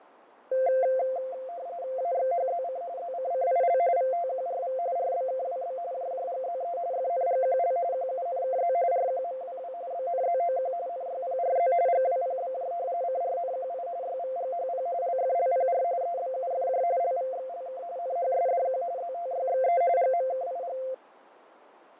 RTTY (45.45 baud, 170 Hz shift), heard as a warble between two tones, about 610 Hz centre, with radio static and fading. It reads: AXHZC ZCCIL VTQRV RBKWB JJGZE FNGQL QUNKZ RQMWW BNZOQ NYPRZ GWPBJ CRNQI YVGHP LFLPR EBUFJ LVXLK NHSDQ ZTYXE GMKIG